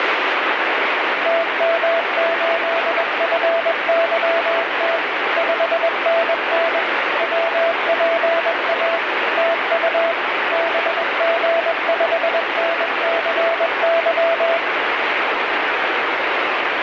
Morse code, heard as a keyed tone, machine-sent, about 21 wpm, 670 Hz, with heavy radio static. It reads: TM8FYT 5NN WPA TU BG5NCY